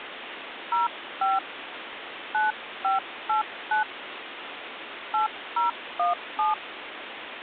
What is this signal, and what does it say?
DTMF, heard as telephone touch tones, dialled by hand, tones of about 150 ms, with phone line noise. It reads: 05 9589 8017